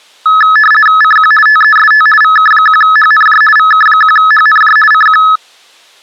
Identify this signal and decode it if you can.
RTTY (50 baud, 450 Hz shift), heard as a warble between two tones, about 1500 Hz centre. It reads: CQ TEST VK1HNJ VK1HNJ CQ